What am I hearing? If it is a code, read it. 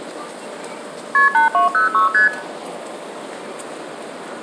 Multi-frequency trunk signalling (R1, as on North American trunks), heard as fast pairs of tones, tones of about 130 ms, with room echo and the noise of a residential street. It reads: KP 8206 ST